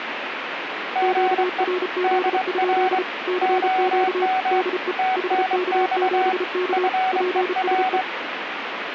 Morse code, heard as two keyed tones, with radio static. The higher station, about 24 wpm, 750 Hz: GE DR OM TNX FER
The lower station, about 33 wpm, 360 Hz: QRZ? CQ DE HK7K PSE